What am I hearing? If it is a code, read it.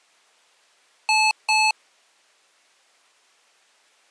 Beep code, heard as beeps from a small speaker, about 870 Hz. 2 short. In AMI BIOS tables: memory parity error; in IBM BIOS tables: self-test error shown on screen; in Dell tables: no memory detected.